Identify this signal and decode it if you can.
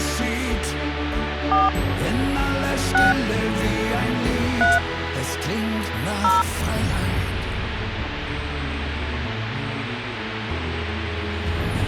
DTMF, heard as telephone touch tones, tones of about 180 ms, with phone line noise. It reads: 4 6 3 0